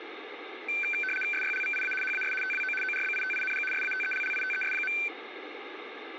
RTTY (75 baud, 850 Hz shift), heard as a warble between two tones, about 1950 Hz centre, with radio static. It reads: SYLVIA HAS TWO ORBITING SATELLITES.